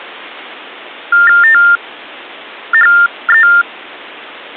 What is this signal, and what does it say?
TTY/TDD text telephone tones (45.45 baud Baudot), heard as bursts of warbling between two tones, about 400 Hz shift, 1600 Hz centre. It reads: THE